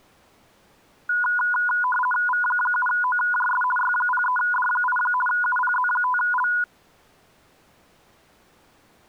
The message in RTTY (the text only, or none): V7OJS Y03D8 UPZ5L